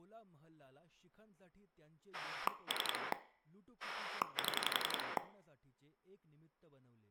Pulse dialling, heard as a rotary dial, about 11 pulses a second, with room echo and speech in Marathi. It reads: 3 7